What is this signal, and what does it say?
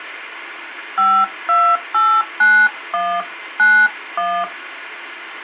DTMF, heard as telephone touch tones, dialled by hand, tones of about 270 ms. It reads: 5289191